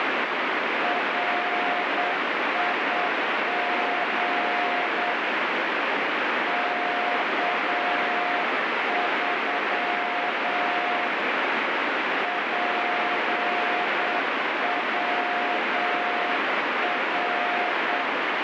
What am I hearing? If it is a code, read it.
Morse code, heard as a keyed tone, hand-sent with a straight key, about 8 wpm, 710 Hz, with heavy radio static. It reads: RIG K3 PWR